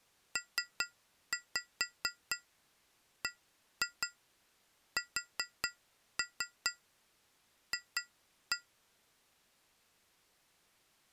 Tap code, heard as taps on glass, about 4 knocks a second. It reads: PBSF